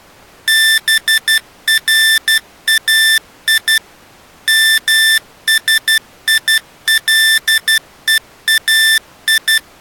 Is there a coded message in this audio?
Yes: Morse code (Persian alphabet) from 0.4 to 9.6 s, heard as electronic beeps, machine-sent, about 12 wpm, 1800 Hz. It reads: برای مسیلهای